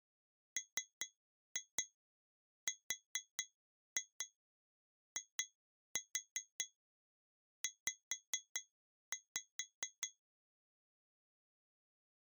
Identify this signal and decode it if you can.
Tap code, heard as taps on glass, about 4 knocks a second. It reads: MRIZ